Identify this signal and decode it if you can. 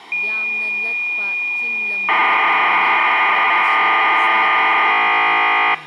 Cassette data (Kansas City type), 1200 baud, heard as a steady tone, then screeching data, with speech in Manipuri.